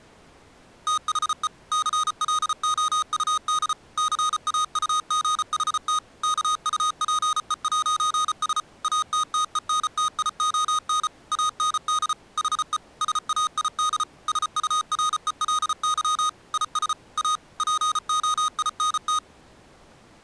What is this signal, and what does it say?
Morse code, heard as electronic beeps, machine-sent, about 34 wpm, 1240 Hz. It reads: THE CLOUD CAUGHT KUPE'S ATTENTION AND HE SAID SURELY IS A POINT